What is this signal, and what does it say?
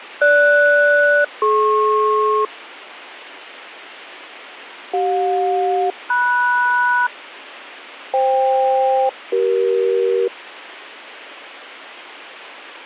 Aircraft SELCAL, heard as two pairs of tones, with radio static. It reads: GS-DP CJ-MS FK-CE